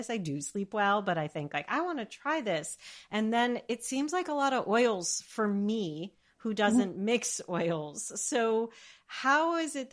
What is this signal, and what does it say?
Speech in English. There is no code.